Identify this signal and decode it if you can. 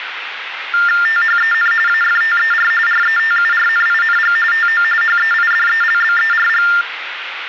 TTY/TDD text telephone tones (45.45 baud Baudot), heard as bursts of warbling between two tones, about 400 Hz shift, 1600 Hz centre, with phone line noise. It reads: THEN AFTER RETURNING TO HEIDELBERG